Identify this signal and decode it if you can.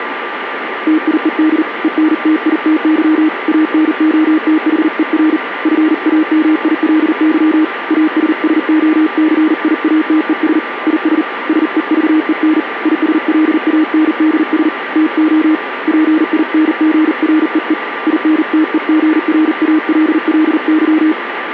Morse code, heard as a keyed tone, hand-sent with a paddle, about 39 wpm, 310 Hz, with radio static and a steady whistle near 1180 Hz. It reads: TIED ENTITY ANOTHER FAMILY ASSOCIATES IS SEVEN ISLANDS TO PINGREE INTEGRALLY